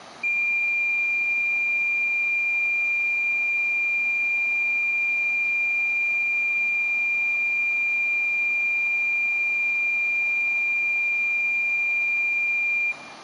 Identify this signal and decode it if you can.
A steady tone, with room echo. There is no code.